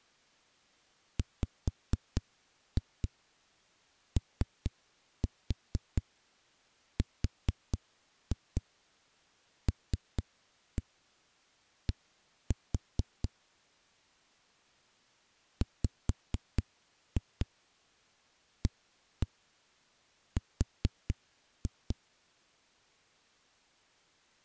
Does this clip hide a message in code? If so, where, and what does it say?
Yes: tap code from 1.2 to 22.0 s, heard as knocks on a wall, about 4 knocks a second. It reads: WORLD WAR